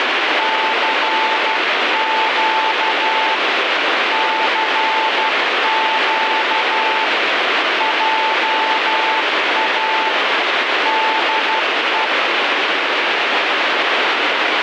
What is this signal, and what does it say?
Morse code, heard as a keyed tone, hand-sent with a paddle, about 12 wpm, 880 Hz, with heavy radio static. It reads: CQ CQ JA DE